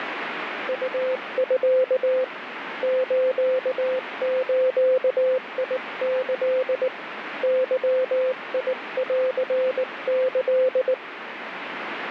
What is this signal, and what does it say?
Morse code (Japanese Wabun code), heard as a keyed tone, hand-sent with a paddle, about 19 wpm, 520 Hz, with radio static. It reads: ウミ スズキ ゲンキ